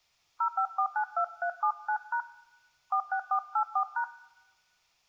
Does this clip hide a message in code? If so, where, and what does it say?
Yes: DTMF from 0.4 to 4.0 s, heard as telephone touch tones, dialled by hand, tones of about 80 ms. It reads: 05492379# 46484#